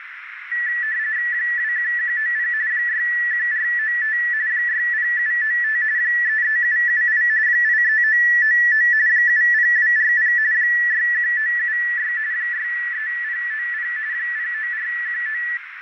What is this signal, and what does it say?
RTTY (45.45 baud, 170 Hz shift), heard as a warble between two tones, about 1850 Hz centre, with radio static, a narrow filter and room echo. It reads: 21190 61495 60795 33778 83999 70240 61976 63090 09419